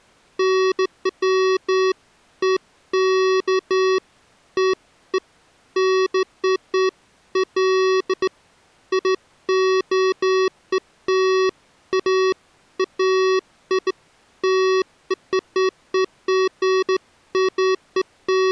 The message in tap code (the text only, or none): none